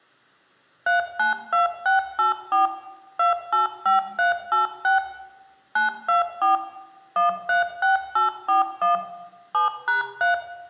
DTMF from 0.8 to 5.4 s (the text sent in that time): 392684 285386